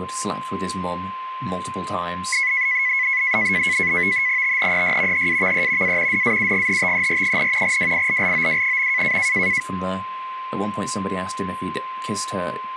NAVTEX (SITOR-B), 100 baud, 170 Hz shift, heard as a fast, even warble, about 2100 Hz centre, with a steady whistle near 1040 Hz and speech in English. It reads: THEY HAVE A DAUGHTER, WILLOW.